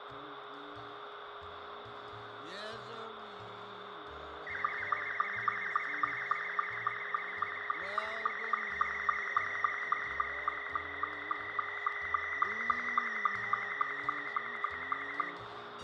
SSTV (slow-scan television), Scottie S2, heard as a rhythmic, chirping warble, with radio static, a steady whistle near 410 Hz and room echo.